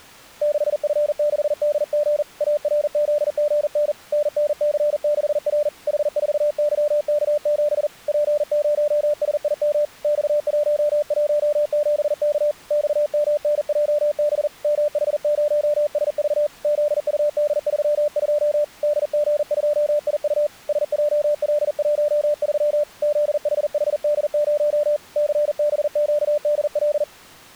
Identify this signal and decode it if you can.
Morse code, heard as a keyed tone, hand-sent with a paddle, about 40 wpm, 590 Hz. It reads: 6F6DG ARZGN NNC6R H4YK7 P0SIM X117K XMNJB MH0SV ZUD32 DG2IU SJL13 ZHHD0 CBQDL